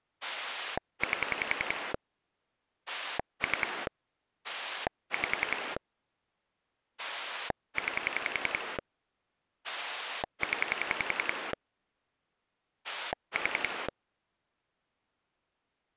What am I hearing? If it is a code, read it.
Pulse dialling, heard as a rotary dial, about 10 pulses a second. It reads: 8 3 5 9 0 4